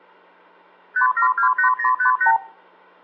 Multi-frequency trunk signalling (R2, with the far end's replies), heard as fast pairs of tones, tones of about 100 ms, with hum and room echo. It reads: 5728058